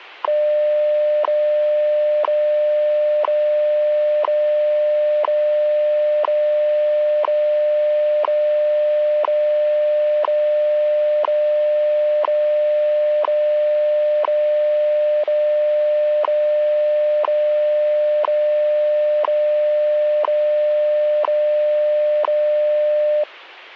Radio time signal (WWV, Colorado), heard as ticks, one a second.